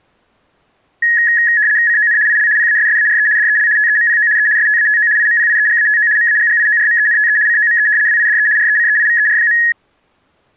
RTTY (75 baud, 170 Hz shift), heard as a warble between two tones, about 1800 Hz centre. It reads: CON IL PASSARE DEL TEMPO E STATO IMPIEGATO MAGGIORMENTE COME WIDE RECEIVER.